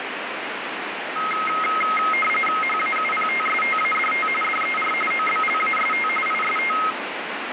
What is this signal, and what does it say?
RTTY (45.45 baud, 850 Hz shift), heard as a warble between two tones, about 1700 Hz centre, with radio static. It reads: HAUPTSTADT DER OBLAST IST